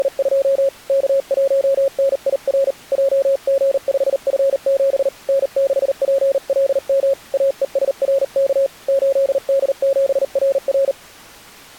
Morse code, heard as a keyed tone, hand-sent with a paddle, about 39 wpm, 550 Hz. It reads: … K1NIR JG5F7 N6PLM AESRK 8D7RR